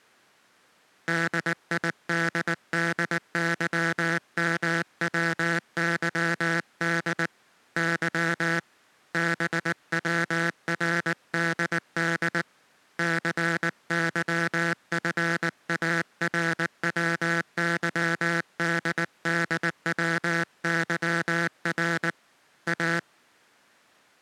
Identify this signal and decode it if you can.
Morse code, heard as a buzzer, hand-sent with a paddle, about 19 wpm. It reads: DIDDYMWYD Y BWRDD CYFARWYDDWYR A